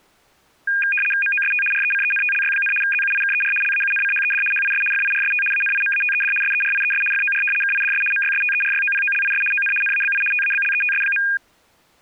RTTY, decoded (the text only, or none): MOST RECENTLY, ZUIKER LAUNCHED HIS FIRST ANIMATED SERIES FOR KIDS MYSTERYOPOLIS ON NABI TABLETS.